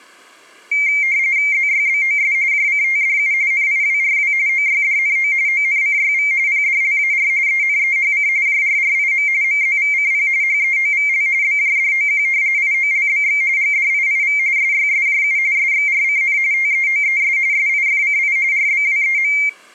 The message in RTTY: ZYBOS JCTDU NIWRW OYDNO ONCYV PDLAR ENEHC JRRIM MZVCP HEOVL BJDOQ IOLBX GDIIV SYSJU SXRCN TEOES SIFCI RBWEM

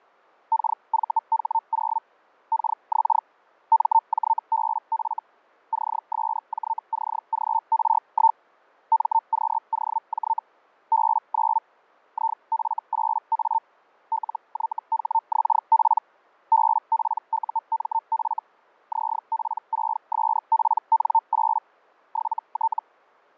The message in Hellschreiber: KVH0 KX MJBF CSJCGR1 MQOJ B9 IF8A LYHXP BPUMF ZP6SPN8 7T

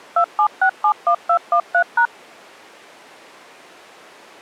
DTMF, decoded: 27671213#

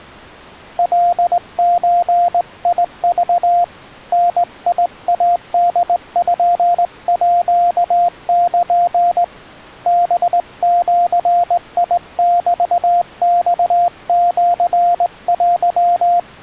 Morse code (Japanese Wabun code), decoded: カゾク ダイポール ハジメマシテ

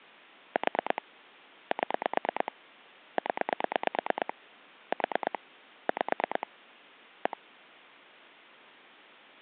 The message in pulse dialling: 4 7 0 4 5 1

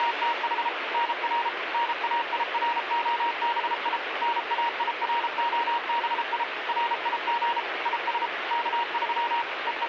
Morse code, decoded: … NR NAIROBI NAIROBI RIG IS K3 …

